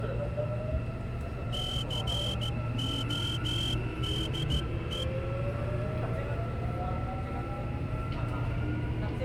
Morse code, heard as a whistle, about 14 wpm, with the noise inside a subway train. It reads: CODE